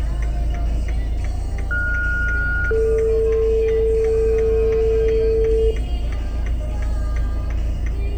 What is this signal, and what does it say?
Two-tone page, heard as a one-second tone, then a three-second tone, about 1430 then 450 Hz, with room echo and the noise inside a car.